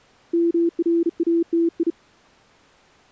Morse code (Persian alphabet), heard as a keyed tone, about 35 wpm, 340 Hz. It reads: مراتی